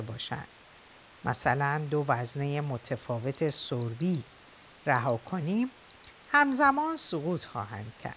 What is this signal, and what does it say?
Beep code, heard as a piezo beeper, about 4100 Hz, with speech in Persian. 3-1-1. In Phoenix BIOS tables: DMA register failure.